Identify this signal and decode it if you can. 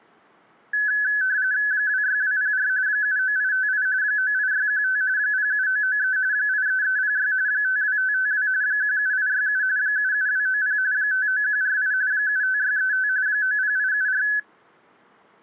RTTY (45.45 baud, 170 Hz shift), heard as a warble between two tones, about 1600 Hz centre. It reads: 26204 79858 98615 07993 83306 52552 17867 77290 59148 75635 90874